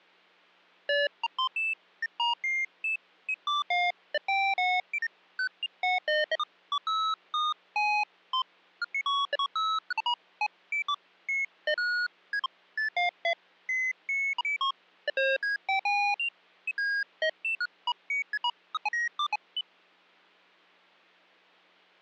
Electronic bleeps of random pitch and length. There is no code.